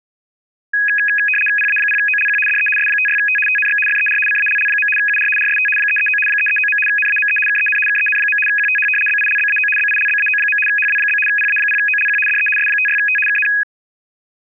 RTTY (75 baud, 850 Hz shift), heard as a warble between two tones, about 2100 Hz centre. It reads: PA0OLQ DE S56T TNX FER CALL. UR RST 339 339. NAME KEN KEN. QTH BILBAO BILBAO. HW? PA0OLQ DE S56T KN